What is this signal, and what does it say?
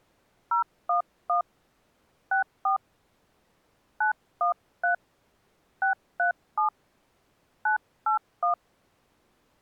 DTMF, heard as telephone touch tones, dialled by hand, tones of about 120 ms. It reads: 011 64 913 637 981